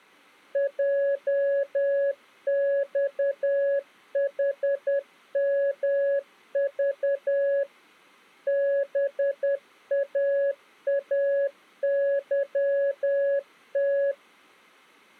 Morse code, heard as a keyed tone, machine-sent, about 10 wpm, 560 Hz. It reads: JXHMV BAAYT